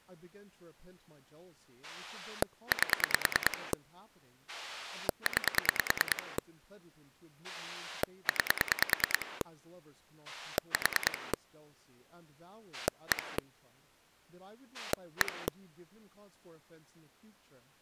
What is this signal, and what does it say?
Pulse dialling, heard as a rotary dial, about 9 pulses a second, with speech in English. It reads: 8 9 9 4 1 1